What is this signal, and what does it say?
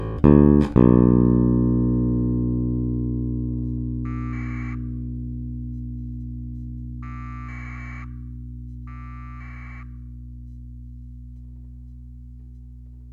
Packet radio (AX.25, as in APRS), 1200 baud, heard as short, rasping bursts.